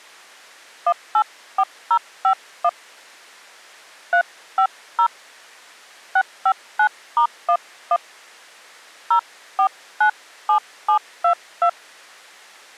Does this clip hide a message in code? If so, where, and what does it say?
Yes: DTMF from 0.9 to 11.7 s, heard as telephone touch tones, dialled by hand, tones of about 70 ms. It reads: 184051 350 659*11 0497722